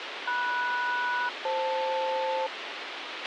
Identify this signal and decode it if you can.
Aircraft SELCAL, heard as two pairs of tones, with radio hiss and a squelch burst at the end. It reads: MS-FL